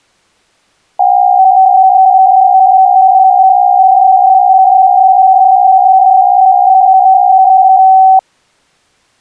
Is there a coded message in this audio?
Yes: PSK63 (62.5 baud) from 1.0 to 8.2 s, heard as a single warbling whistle, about 760 Hz.